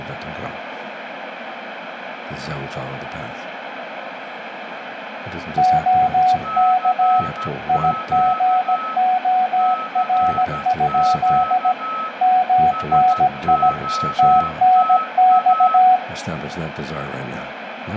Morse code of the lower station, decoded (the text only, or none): OK IGOR? MNI TNX